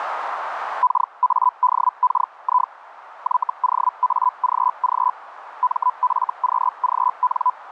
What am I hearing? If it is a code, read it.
Hellschreiber (Feld-Hell, 122.5 baud), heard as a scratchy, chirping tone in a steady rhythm, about 1000 Hz, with radio static. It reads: KADKI YOAGG MFQGN